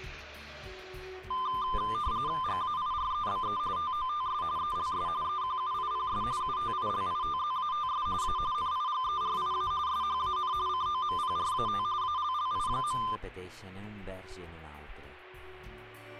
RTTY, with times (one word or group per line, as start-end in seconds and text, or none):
2.4-3.6 GAIREBE
3.8-4.4 TOTS
4.6-5.1 ELS
5.2-6.2 EQUIPS
6.4-8.1 UTILITZATS
8.2-8.4 A
8.5-9.7 NIGERIA
9.9-10.5 SHAN
10.7-11.8 COMPRAT
12.0-13.0 ALLI.